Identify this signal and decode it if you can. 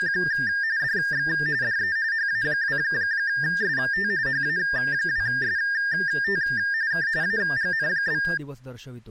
RTTY (45.45 baud, 170 Hz shift), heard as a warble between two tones, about 1700 Hz centre, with speech in Marathi. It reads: … DX DE HA2ST HA2ST K AGN?